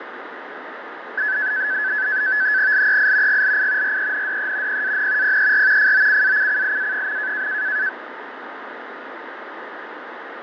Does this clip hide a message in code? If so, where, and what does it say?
Yes: NAVTEX (SITOR-B), 100 baud, 170 Hz shift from 1.2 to 7.9 s, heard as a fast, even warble, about 1600 Hz centre, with radio static and fading. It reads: LEI GLI RENDE PAN PER FOCACCIA.